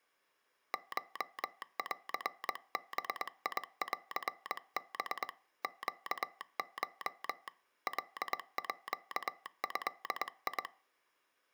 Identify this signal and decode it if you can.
Morse code (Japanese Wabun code), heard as a telegraph sounder, hand-sent with a paddle, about 21 wpm. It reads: コンバンハ ネコ カード